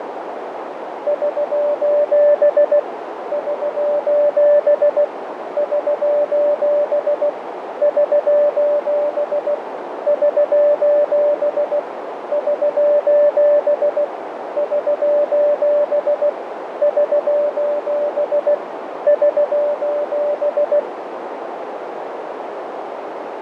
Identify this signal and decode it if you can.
Morse code, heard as a keyed tone, machine-sent, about 16 wpm, 590 Hz, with radio static, fading and a narrow filter. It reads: <SOS> <SOS> <SOS> <SOS> <SOS> <SOS> <SOS> <SOS> <SOS>